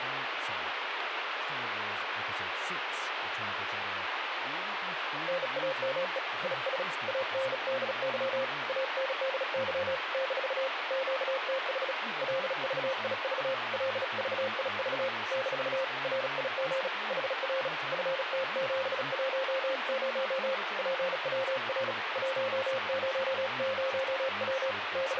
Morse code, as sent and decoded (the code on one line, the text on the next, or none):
-. .- -- . / .. ... / .- -. -.. -.-- / .- -. -.. -.-- / -....- / --.- - .... / .-.. ...- .. ...- / .-.. ...- .. ...- / -....- / .-. .. --. / .... .-. / ..-. - --... .---- ----- / .--. .-- .-. / .---- ----- ----- .-- / …
NAME IS ANDY ANDY - QTH LVIV LVIV - RIG HR FT710 PWR 100W …